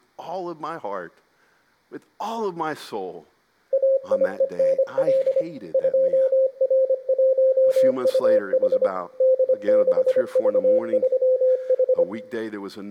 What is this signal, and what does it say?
Morse code, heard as a keyed tone, machine-sent, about 25 wpm, 520 Hz, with room echo and speech in English. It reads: AIENL 2R1UH D6V3H